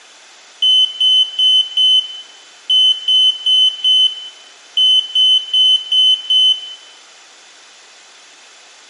Beep code, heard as a piezo beeper, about 3050 Hz, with room echo. 4-4-5.